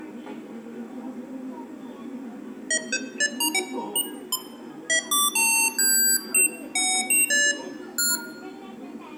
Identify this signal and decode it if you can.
Electronic bleeps of random pitch and length, with room echo and the noise of a park. There is no code.